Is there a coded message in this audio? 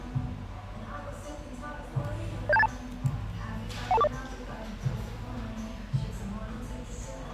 Yes: five-tone selective call (EIA) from 2.5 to 4.1 s, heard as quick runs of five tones, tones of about 30 ms, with the noise of a cafe. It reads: 07282 12240